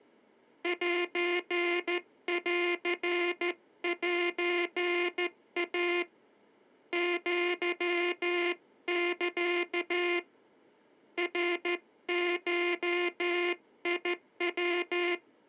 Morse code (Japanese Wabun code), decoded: センセイ アサ ナゴヤ

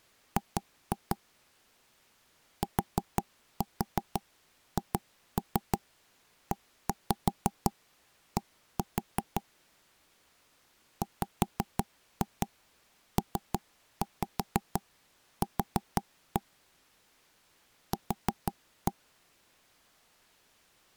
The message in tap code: G THED WPQ Q

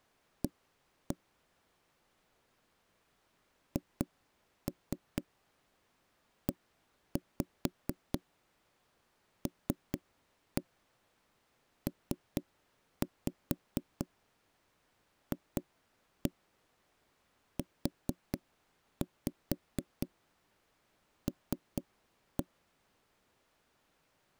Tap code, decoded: A HELPFUL

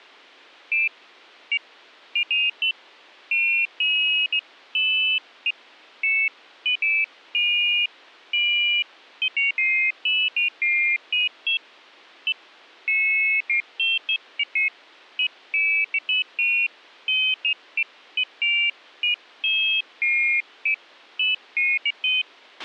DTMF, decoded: none

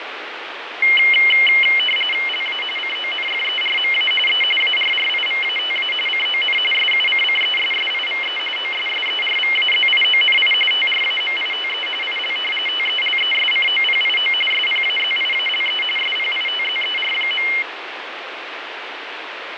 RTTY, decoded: LA CONFERMA E ARRIVATA CON SUCCESSIVE OSSERVAZIONI TRAMITE IL TELESCOPIO SPAZIALE SPITZER.

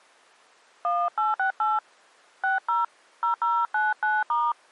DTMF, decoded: 1868 60 0099*

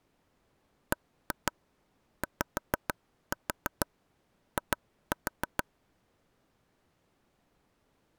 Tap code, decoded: BYI

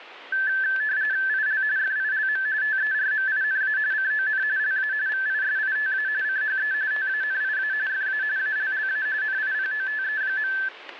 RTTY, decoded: IL FILM TERMINA CON LA VISITA CHE TANIA FA ALLA NIPOTE.

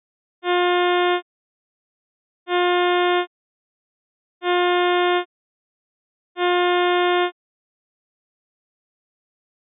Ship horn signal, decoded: 4 short

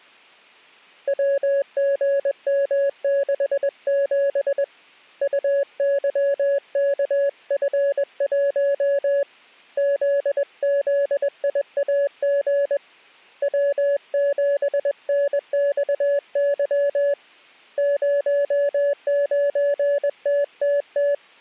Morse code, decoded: WGM67 UYKF1 ZZIAG W7NXY 09TTT

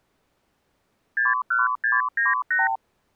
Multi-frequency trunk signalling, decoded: 61698

